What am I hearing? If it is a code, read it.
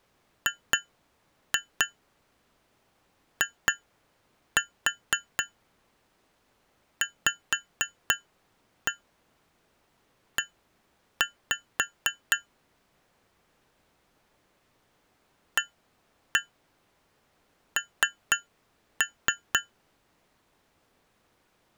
Tap code, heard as taps on glass, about 4 knocks a second. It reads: GIVE AN